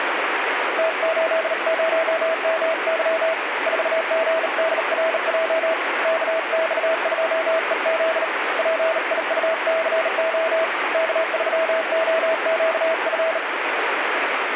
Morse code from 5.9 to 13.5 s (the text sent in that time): KX2EZ PIUCO K3OQF